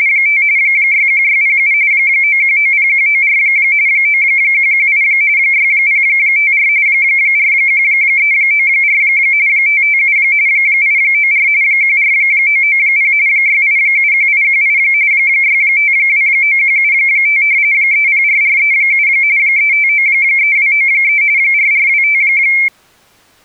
RTTY (45.45 baud, 170 Hz shift), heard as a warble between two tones, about 2250 Hz centre. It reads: … 61607 9190194 9118 6054 41394 557 894 14990 6871818 6529175 304437 3593293 4425